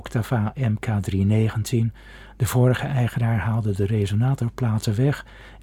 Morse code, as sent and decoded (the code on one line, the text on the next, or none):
none